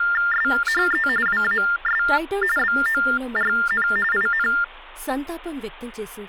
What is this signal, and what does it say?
TTY/TDD text telephone tones (45.45 baud Baudot), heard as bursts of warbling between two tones, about 400 Hz shift, 1600 Hz centre, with speech in Telugu. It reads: SHE WAS BORN IN